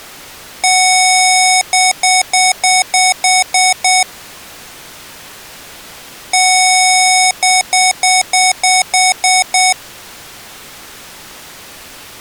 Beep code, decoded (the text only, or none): 1 long, 8 short